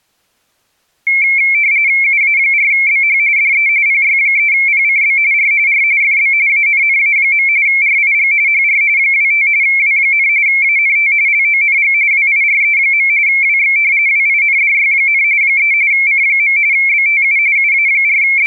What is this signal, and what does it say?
RTTY (45.45 baud, 170 Hz shift), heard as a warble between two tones, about 2250 Hz centre. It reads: UA4BH DE PY3PCB R R FB ANNA. RIG HR 25 W, ANT LONG WIRE. WX WINDY, 3 C. BTU …